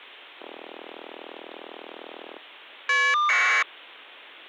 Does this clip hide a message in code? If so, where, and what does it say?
Yes: caller ID data burst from 0.4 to 3.6 s, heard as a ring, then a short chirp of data, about 1200 baud.